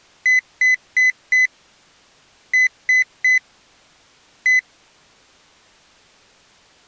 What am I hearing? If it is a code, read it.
Beep code, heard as a piezo beeper, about 2000 Hz. 4-3-1. In Phoenix BIOS tables: memory failure above the first 64 KB.